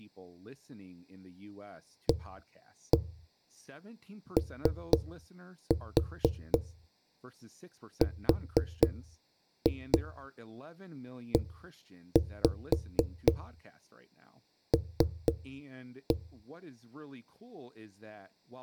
Tap code, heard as knocks on a wall, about 4 knocks a second, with room echo and speech in English. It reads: AOREL